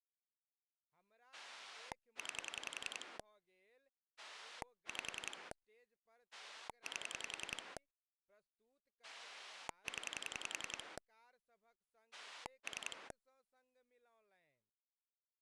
Pulse dialling, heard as a rotary dial, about 10 pulses a second, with speech in Maithili. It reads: 9 5 8 0 3